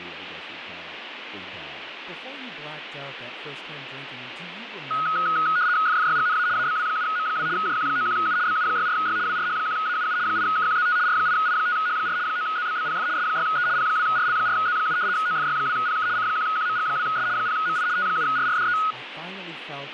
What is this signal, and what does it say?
RTTY (75 baud, 170 Hz shift), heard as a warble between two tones, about 1360 Hz centre, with radio static and speech in English. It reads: FFYGNA ABW7M2 JQ91U BU64Y WRH1AUU 8KQZT R8I5H4 9ZBBPF S6E P2RL4Z7 OFY2PK C1QMG2S 0MI T7RRDE